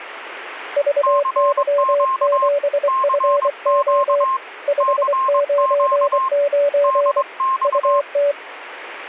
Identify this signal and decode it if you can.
Morse code, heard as two keyed tones. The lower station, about 24 wpm, 570 Hz: VY7FO 599 UT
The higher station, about 22 wpm, 1060 Hz: CQ CQ CQ DX